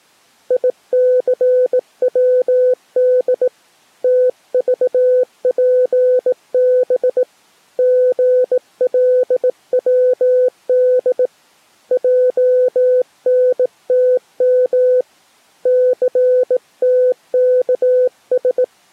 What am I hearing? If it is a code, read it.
Morse code, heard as a keyed tone, hand-sent with a bug key, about 18 wpm, 500 Hz. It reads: ICWD TVPB GLWD JNTM CTKS